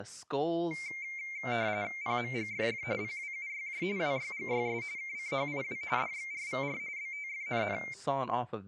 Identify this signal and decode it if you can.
RTTY (45.45 baud, 170 Hz shift), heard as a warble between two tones, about 2200 Hz centre, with speech in English. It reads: PMGFF PWUYJ WYGYS KCHIW DXRVR BTFNN